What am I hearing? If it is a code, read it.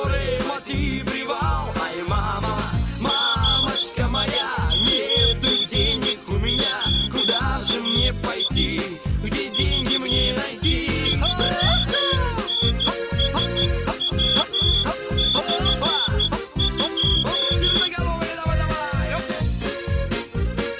Morse code, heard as a whistle, hand-sent with a straight key, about 13 wpm. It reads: GI9OAI VE3NSW/2